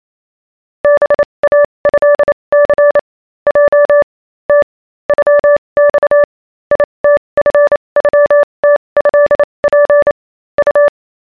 Morse code (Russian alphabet), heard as a keyed tone, machine-sent, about 28 wpm, spaced as for 23 wpm, 580 Hz. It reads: БАЭЦ Й Т ЮЬ ИТФЮТЭП У